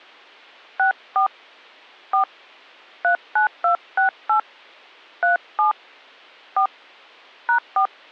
DTMF, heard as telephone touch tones, dialled by hand, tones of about 110 ms. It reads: 64 4 39268 37 4 #4